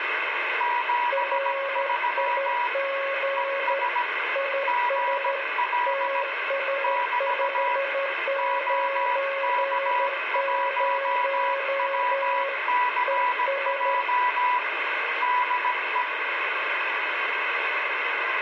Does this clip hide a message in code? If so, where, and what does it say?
Yes: Morse code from 0.5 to 16.1 s, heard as two keyed tones, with radio static and room echo. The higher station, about 17 wpm, 980 Hz: 73 ES GL <BT> OK1WCJ DE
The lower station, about 13 wpm, 550 Hz: RIG IS TS590 ES